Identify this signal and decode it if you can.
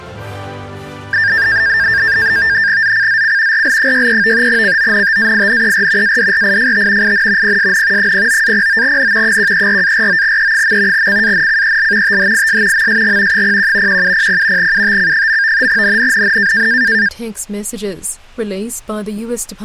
NAVTEX (SITOR-B), 100 baud, 170 Hz shift, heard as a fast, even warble, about 1700 Hz centre. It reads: ZCZC RL63 CONTAINER ADRIFT IN PSN 09-09N 134-49E. CANCEL THIS MSG 01 1700 UTC. NNNN